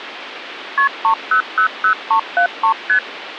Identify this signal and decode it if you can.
Multi-frequency trunk signalling (R1, as on North American trunks), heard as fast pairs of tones, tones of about 90 ms, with phone line noise. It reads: KP 3000373 ST